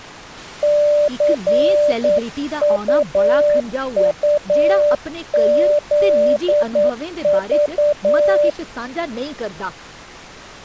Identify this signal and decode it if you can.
Morse code, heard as a keyed tone, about 9 wpm, 590 Hz, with speech in Dogri. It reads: CUUZV